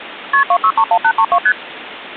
Multi-frequency trunk signalling (R1, as on North American trunks), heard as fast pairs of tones, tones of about 70 ms, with phone line noise. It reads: KP 2631832 ST